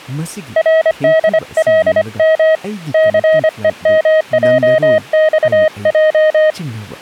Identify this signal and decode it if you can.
Morse code, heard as a keyed tone, hand-sent with a paddle, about 25 wpm, 630 Hz, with speech in Manipuri. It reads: RDLM CEMJXJ